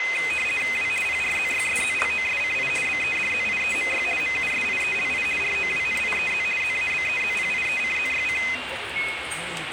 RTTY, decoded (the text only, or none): W PRZYSZLOSCI BEDZIEMY MUSIELI ROWNIEZ ZABEZPIECZYC